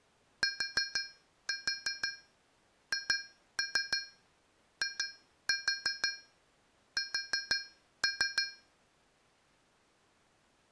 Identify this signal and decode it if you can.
Tap code, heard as taps on a metal pipe, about 6 knocks a second. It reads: THIS